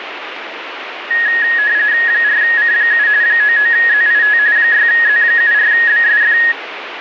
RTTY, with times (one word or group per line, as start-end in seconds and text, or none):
2.1-3.1 4C7
3.2-4.4 99ZIT
4.6-6.4 6Z74BSF